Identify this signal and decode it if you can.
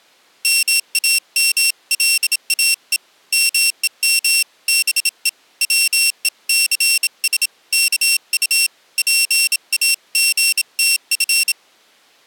Morse code (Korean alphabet), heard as a high beeper, hand-sent with a bug key, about 27 wpm, 2700 Hz. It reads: 몸과 맘 다 바쳐 이 조선